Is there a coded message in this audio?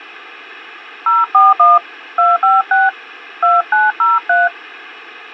Yes: DTMF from 1.1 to 4.5 s, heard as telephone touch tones, dialled by hand, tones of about 180 ms, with hum. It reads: 041 256 2903